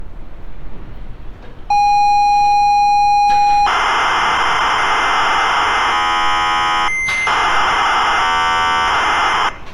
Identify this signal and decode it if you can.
ZX Spectrum tape loading, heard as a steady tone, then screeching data, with street noise.